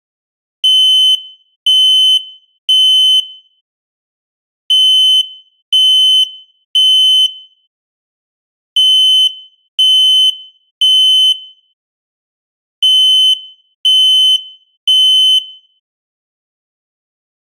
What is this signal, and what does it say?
Alarm pattern, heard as an alarm's beeps, played four times, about 3050 Hz, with room echo. Temporal three. Smoke or fire, evacuate.